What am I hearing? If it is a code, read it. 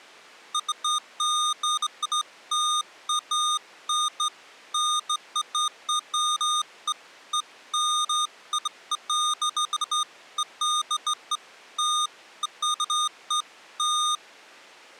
Beeps of irregular length. There is no code.